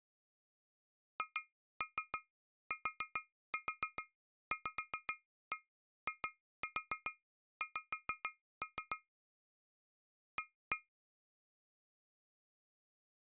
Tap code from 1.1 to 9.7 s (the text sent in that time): HTVIX